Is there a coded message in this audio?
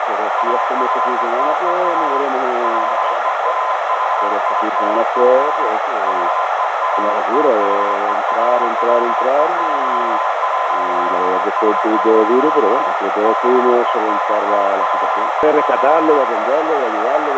Yes: Morse code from 0.3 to 16.3 s, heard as a keyed tone, hand-sent with a straight key, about 25 wpm, 1020 Hz, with radio static, a narrow filter and room echo. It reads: AFTER LEAVING HEATHERLEY'S, BENTLEY